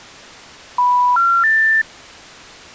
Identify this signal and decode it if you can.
Telephone call progress tone (North American plan), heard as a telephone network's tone, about 980, 1370, 1800 Hz. Special information tone.